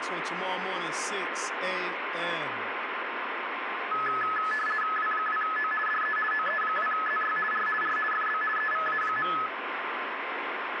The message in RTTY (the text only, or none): W2O DE OE2ZY R R FB EVA.